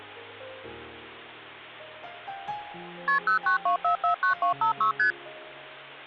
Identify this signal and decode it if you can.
Multi-frequency trunk signalling (R1, as on North American trunks), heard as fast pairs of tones, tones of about 110 ms. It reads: KP 092449256 ST